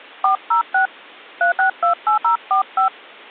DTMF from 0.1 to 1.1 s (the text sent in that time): 406